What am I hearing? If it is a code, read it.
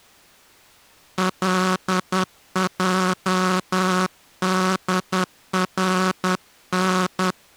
Morse code, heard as a buzzer, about 10 wpm. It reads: LJDRN